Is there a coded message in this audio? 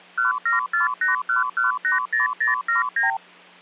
Yes: multi-frequency trunk signalling (R2, with the far end's replies) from 0.2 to 3.2 s, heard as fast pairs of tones, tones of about 140 ms, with hum. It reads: 17481180079